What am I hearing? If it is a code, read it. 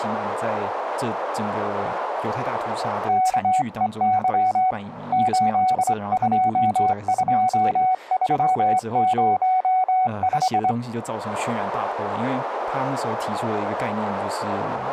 Morse code, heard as a keyed tone, hand-sent with a straight key, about 24 wpm, 750 Hz, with speech in Chinese. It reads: KEY 822305